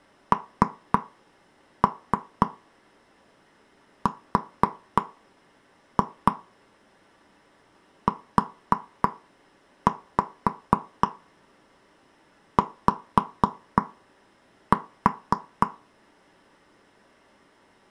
Tap code, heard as taps on a table, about 3 knocks a second. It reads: NRUY